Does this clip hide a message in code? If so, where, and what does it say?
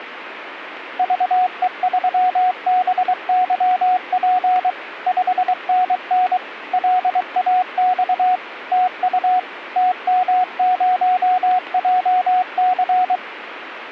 Yes: Morse code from 0.9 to 13.2 s, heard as a keyed tone, machine-sent, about 23 wpm, 730 Hz, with radio static. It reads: VE3BYP 5NN LAX TU TM0JC